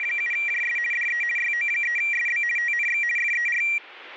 RTTY (50 baud, 450 Hz shift), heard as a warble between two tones, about 2150 Hz centre, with radio static. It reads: … DE YO3SB TNX FER